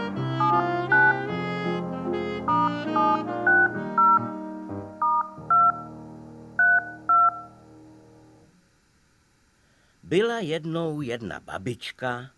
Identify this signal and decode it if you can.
DTMF, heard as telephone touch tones, dialled by hand, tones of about 200 ms. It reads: 79 *760 *2 32